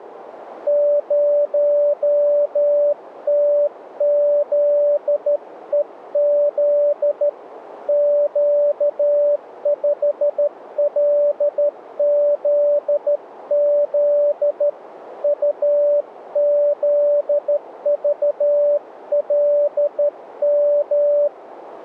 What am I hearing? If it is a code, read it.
Morse code, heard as a keyed tone, hand-sent with a straight key, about 13 wpm, 580 Hz, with radio static. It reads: 0TZEZ Q5LZZ UZVLM